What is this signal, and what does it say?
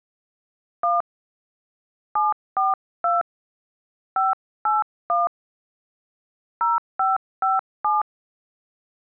DTMF, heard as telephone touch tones, dialled by hand, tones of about 170 ms. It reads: 1 742 581 0557